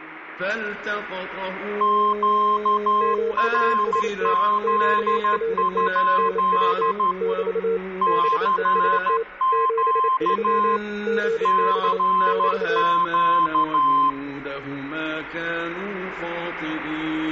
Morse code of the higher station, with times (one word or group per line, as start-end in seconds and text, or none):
1.8-7.1 QRZ?
8.0-10.8 CQ
11.5-14.1 CQ